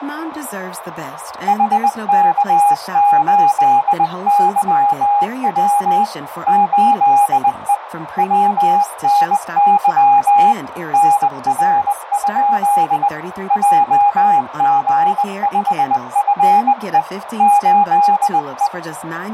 Morse code, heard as a keyed tone, hand-sent with a bug key, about 20 wpm, 820 Hz, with radio static, a narrow filter and speech in English. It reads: HK8YW 8E WNY NR? JG5FE 8E